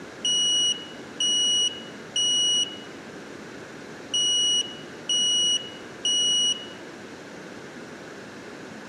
Alarm pattern, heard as an alarm's beeps, played twice, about 2900 Hz, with room echo. Temporal three. Smoke or fire, evacuate.